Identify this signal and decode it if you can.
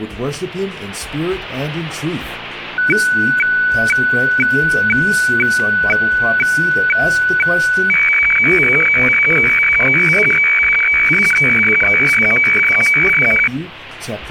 Weather fax (radiofax), 120 lines a minute, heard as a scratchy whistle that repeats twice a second, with static crashes.